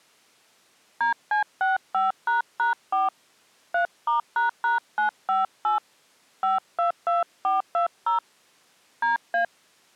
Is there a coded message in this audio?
Yes: DTMF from 1.0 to 9.4 s, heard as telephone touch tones, dialled by hand, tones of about 140 ms. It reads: DC65##4 3*##958 522420 DA